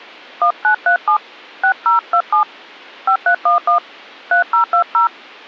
DTMF, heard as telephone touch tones, dialled by hand, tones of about 100 ms. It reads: 1937 6027 5311 3020